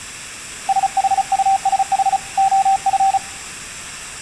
Morse code, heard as a keyed tone, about 35 wpm, 780 Hz. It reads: SHUSH OF